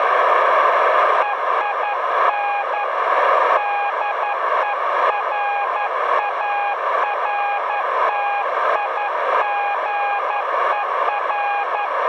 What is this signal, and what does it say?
Morse code, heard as a keyed tone, hand-sent with a paddle, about 11 wpm, 810 Hz, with radio static, a narrow filter and room echo. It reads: EIN DERARTIGER